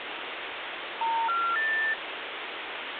Telephone call progress tone (North American plan), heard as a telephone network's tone, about 910, 1370, 1800 Hz, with phone line noise. Special information tone.